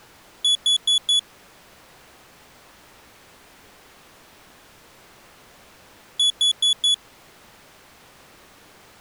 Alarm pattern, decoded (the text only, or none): temporal four